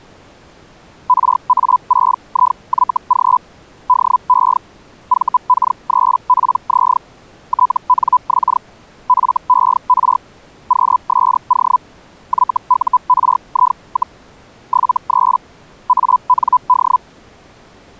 Hellschreiber (Feld-Hell, 122.5 baud), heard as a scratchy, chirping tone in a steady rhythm, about 1000 Hz. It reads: RA6IYG DE VK3PZ TNX FER QSO YURI, 73 AND